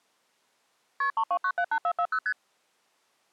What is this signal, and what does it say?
Multi-frequency trunk signalling (R1, as on North American trunks), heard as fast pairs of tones, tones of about 70 ms. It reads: KP 32978440 ST